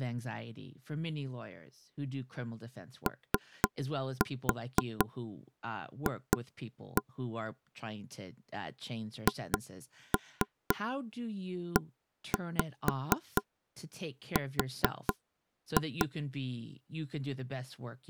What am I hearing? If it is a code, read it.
Tap code, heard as taps on a table, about 4 knocks a second, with speech in English. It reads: OF HER